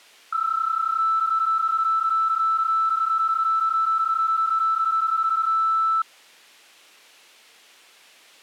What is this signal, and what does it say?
PSK31 (31.25 baud), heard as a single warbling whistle, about 1320 Hz.